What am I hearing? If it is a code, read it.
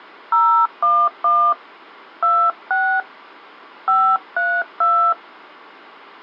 DTMF, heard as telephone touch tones, dialled by hand, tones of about 300 ms. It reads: 011 26 532